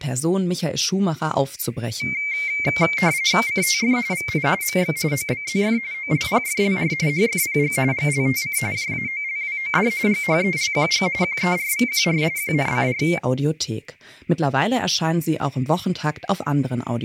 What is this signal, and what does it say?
RTTY (45.45 baud, 170 Hz shift), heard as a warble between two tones, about 2200 Hz centre, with speech in German. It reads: CTF VI MX OBZF OLPFLR HFPG GLTC JAOLWOD GHELQG QERVQR QNCR